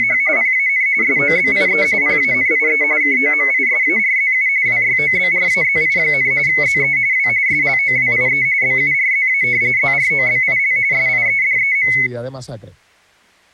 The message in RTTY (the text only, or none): … PAN SOBIE PANIE KOMISARZU WYOBRAZI, ZE W SLOWIE BURZA ZROBIL SIEDEM